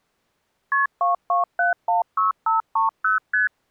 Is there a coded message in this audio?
Yes: multi-frequency trunk signalling (R1, as on North American trunks) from 0.7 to 3.5 s, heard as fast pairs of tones, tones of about 140 ms. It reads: KP 22716530 ST